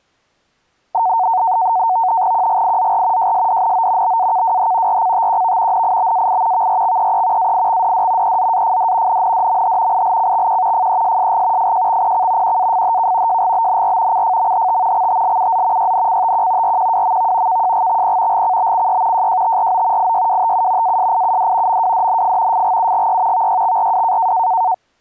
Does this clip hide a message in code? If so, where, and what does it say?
Yes: NAVTEX (SITOR-B), 100 baud, 170 Hz shift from 0.9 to 24.7 s, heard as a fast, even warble, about 820 Hz centre. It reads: QGIZR JSDNO BAKWH RCTQV NIBAI VRXEE AIXDD EZAFD NNDMH ILCXQ FESSG FJXPC QAFHK JGBNR CFMHT XTLUZ YNCTQ RQWMV KJGXP GCBCY JJTRO IYWTU ASIUD MWDNF FGUGY VYXRW